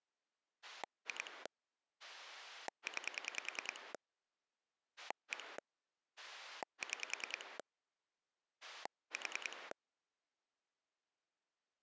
Pulse dialling, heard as a rotary dial, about 10 pulses a second. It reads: 2 9 1 6 4